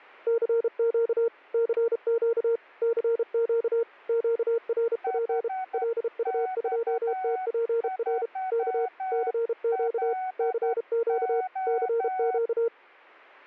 Morse code, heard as two keyed tones, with static crashes. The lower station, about 32 wpm, 460 Hz: CQ CQ CQ QRP LU2TPR K CQ CQ CQ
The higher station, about 11 wpm, 750 Hz: HX3LO